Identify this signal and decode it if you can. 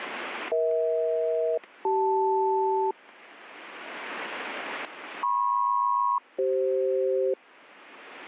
Aircraft SELCAL, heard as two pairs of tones, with static crashes. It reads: EH-CL MP-CF